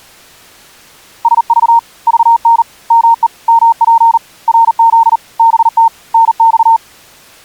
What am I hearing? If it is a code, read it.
Morse code, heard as a keyed tone, hand-sent with a paddle, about 39 wpm, 920 Hz. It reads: SV VN ME MP RZ BT NX